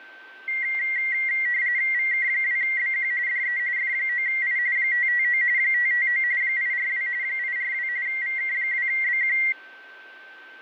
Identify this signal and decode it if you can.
RTTY (45.45 baud, 170 Hz shift), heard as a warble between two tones, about 2000 Hz centre, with a steady whistle near 1550 Hz. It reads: VK2BQ DE F9I 559 559 842 842 VK2BQ